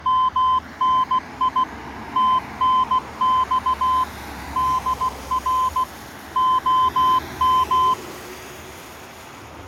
Morse code, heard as a keyed tone, machine-sent, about 16 wpm, 1030 Hz, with street noise. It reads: MNI TNX DR OM